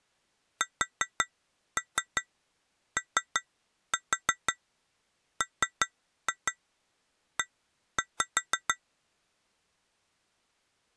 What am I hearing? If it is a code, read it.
Tap code, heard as taps on glass, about 5 knocks a second. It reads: SOME